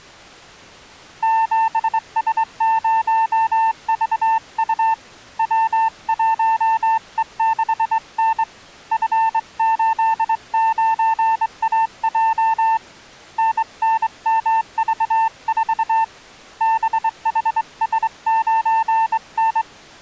Morse code, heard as a keyed tone, hand-sent with a straight key, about 23 wpm, 900 Hz. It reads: 7S0VU W1E6N F89AJ NNMV4 BHS9N